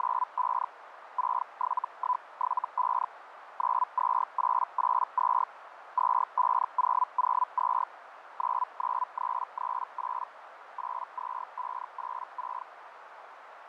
Hellschreiber (Feld-Hell, 122.5 baud), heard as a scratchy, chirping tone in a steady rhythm, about 1000 Hz, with radio static, fading and a narrow filter. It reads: … 67175 92882 25002 99338 82586